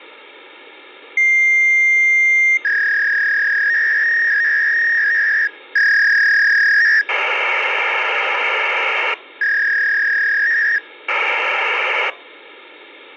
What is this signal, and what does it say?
Fax machine handshake, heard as a long tone, a warble and hiss.